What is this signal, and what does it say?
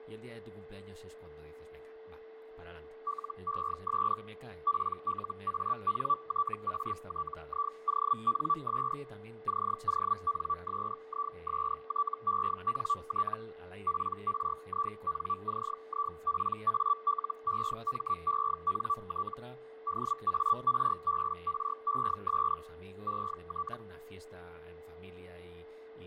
Hellschreiber (Feld-Hell, 122.5 baud), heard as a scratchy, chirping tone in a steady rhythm, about 1160 Hz, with fading, a steady whistle near 440 Hz and speech in Spanish. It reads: LES PLANTATIONS CONSISTENT PRINCIPALEMENT DARBRES ET